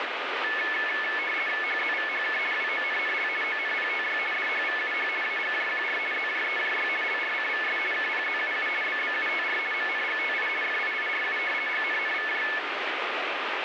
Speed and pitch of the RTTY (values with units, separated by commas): 50 baud, 450 Hz shift, 1950 Hz centre